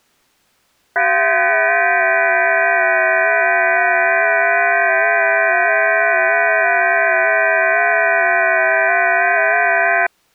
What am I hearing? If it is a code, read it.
FT8 (several signals at once), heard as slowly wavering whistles, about 6.25 baud.